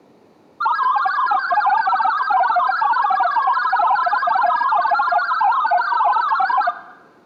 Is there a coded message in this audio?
Yes: multi-tone FSK (Olivia or MFSK type), about 1000 Hz wide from 0.6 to 6.7 s, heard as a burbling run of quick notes, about 62.5 baud.